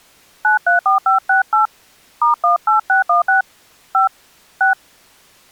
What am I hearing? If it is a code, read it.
DTMF, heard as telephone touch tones, dialled by hand, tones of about 130 ms. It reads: 934568 *18616 5 6